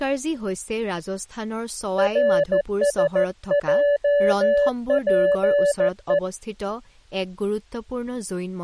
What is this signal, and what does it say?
Morse code, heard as a keyed tone, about 14 wpm, 580 Hz, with speech in Assamese. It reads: RSJPE